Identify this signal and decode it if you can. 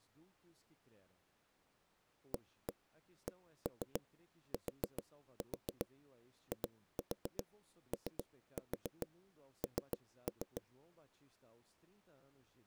Tap code, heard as knocks on wood, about 7 knocks a second, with speech in Portuguese. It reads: ACTION